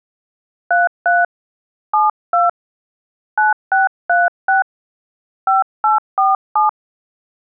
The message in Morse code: none

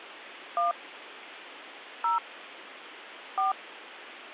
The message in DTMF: 1 0 4

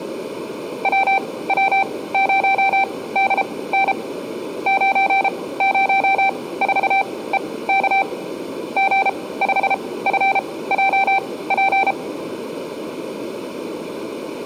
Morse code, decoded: WW0DN 904EK G5FJP

